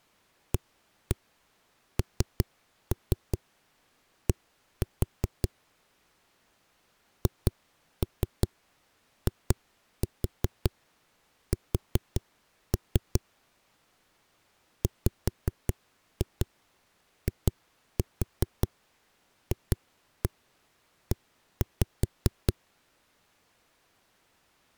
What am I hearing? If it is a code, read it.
Tap code, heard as knocks on a wall, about 5 knocks a second. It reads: AND HIS WIFE